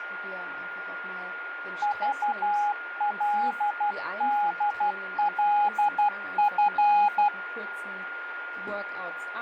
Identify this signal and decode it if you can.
Morse code, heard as a keyed tone, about 12 wpm, 830 Hz, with radio static, a steady whistle near 1420 Hz and speech in German. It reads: VLDLF